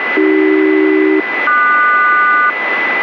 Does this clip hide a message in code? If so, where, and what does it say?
Yes: aircraft SELCAL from 0.2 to 2.5 s, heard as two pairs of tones, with radio static and a steady whistle near 2000 Hz. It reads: AC-QS